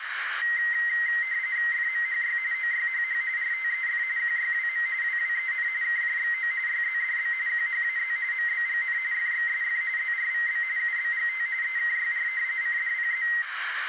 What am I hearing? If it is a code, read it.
RTTY (45.45 baud, 170 Hz shift), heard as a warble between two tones, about 2000 Hz centre, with radio static, a narrow filter and room echo. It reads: FMHY OYHH RTEF QYWM WWEN KJXO YZDB QHAZ MBGN FXSF ZRVB UBGT EKYR CDPZ